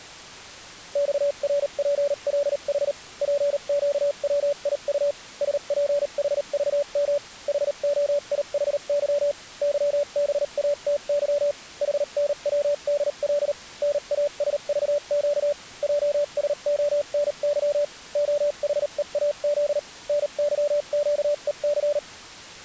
Morse code, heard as a keyed tone, machine-sent, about 38 wpm, spaced as for 33 wpm, 580 Hz. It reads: XRPLH PQWIU SPHVM HOIHY YBATY HNWDL NASVQ JSONY OHEAZ NYQEC